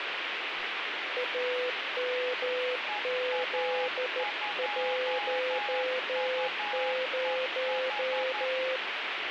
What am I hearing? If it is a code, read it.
Morse code, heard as two keyed tones, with radio static and speech in Maithili. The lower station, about 14 wpm, 510 Hz: AMZ10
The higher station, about 11 wpm, 820 Hz: EA2UEH